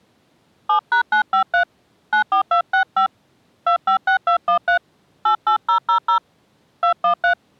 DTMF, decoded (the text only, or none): 7#953 94265 256213 88000 213